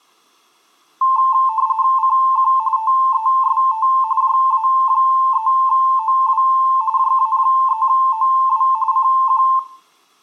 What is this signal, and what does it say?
RTTY (45.45 baud, 170 Hz shift), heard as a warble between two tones, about 970 Hz centre, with room echo. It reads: CQ TEST JA3OW JA3OW CQ